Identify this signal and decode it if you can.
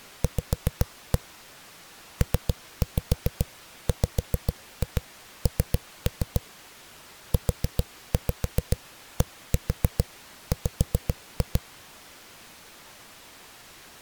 Tap code, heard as knocks on a wall, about 7 knocks a second. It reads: V PWN UDW